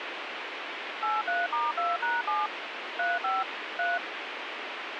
DTMF, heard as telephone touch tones, dialled by machine, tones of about 190 ms, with radio hiss. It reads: 83*2#7 35 3